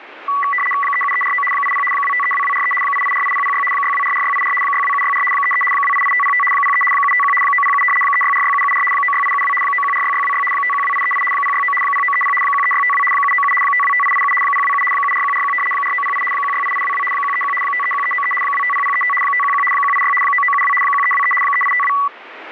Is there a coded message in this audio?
Yes: RTTY (75 baud, 850 Hz shift) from 0.3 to 22.1 s, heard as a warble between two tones, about 1550 Hz centre, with radio static. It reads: 37349 80 2532243 8848006 6244684 62764 33 288505 03 751 907 3646774 96872 9146626 512838 069 0930 13652 797 525887 027 74141 4908 168822 131 531393 250035 511 186 9972 1323 3852